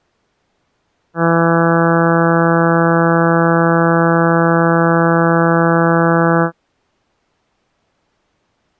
Ship horn signal, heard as a ship's horn, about 170 Hz. 1 long. At sea: a vessel nearing a blind bend, or under power and making way in fog.